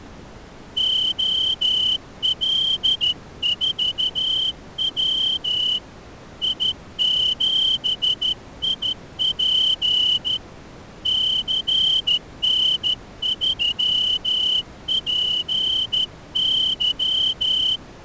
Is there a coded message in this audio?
Yes: Morse code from 0.7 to 17.8 s, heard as a whistle, hand-sent with a straight key, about 13 wpm. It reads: OL4W I7IP CN3PY